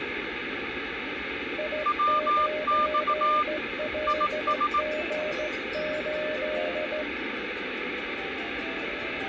Morse code, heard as two keyed tones, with radio static and the noise of a subway station. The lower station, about 15 wpm, 610 Hz: I9LG8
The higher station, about 18 wpm, 1200 Hz: WX IS